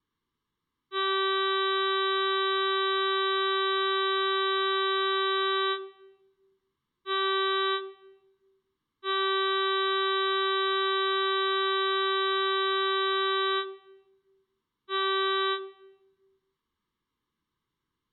Ship horn signal, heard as a ship's horn, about 390 Hz. 1 long, 1 short, 1 long, 1 short. At sea: I agree to be overtaken.